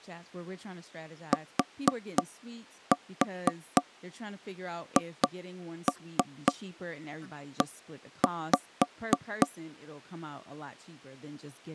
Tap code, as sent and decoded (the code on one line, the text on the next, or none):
4-4 2-3 1-5
THE